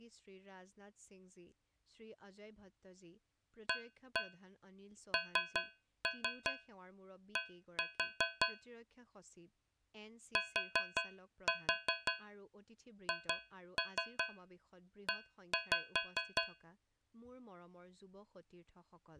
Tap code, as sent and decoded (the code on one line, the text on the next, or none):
1-1 3-3 1-4 / 4-4 2-3 1-5
AND THE